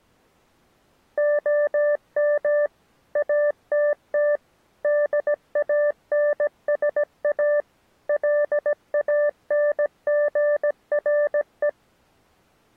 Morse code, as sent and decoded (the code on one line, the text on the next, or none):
--- -- / .- - - / -.. .- -. ... .- / .-.. .- -. --. .-. .
OM ATT DANSA LANGRE